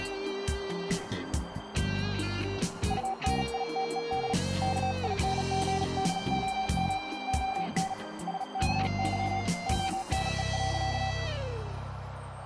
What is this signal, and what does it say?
Morse code, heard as a keyed tone, hand-sent with a bug key, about 37 wpm, 770 Hz, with heavy radio static and a narrow filter. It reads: UNITED KINGDOM ON SKY ONE.